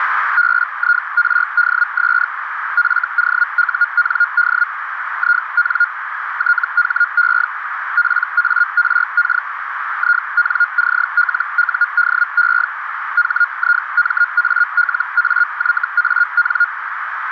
Hellschreiber (Feld-Hell, 122.5 baud), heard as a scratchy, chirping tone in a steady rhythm, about 1420 Hz, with radio static and a narrow filter. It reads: BIRDS FOUND IN THE PARK INCLUDE HIMALAYAN